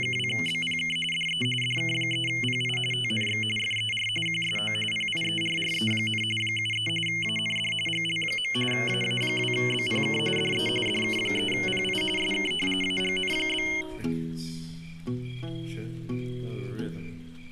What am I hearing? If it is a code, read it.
RTTY (45.45 baud, 850 Hz shift), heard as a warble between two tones, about 2550 Hz centre. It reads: … DE DK3PI TNX FER QSO PIERRE, 73 AND GL. AA2BPK DE DK3PI SK AGN?